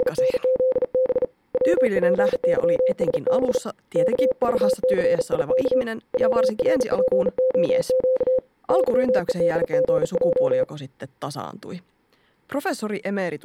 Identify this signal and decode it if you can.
Morse code, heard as a keyed tone, hand-sent with a bug key, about 38 wpm, 520 Hz, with speech in Finnish. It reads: … WPYSB KVCIK WRPOQ YEDGJ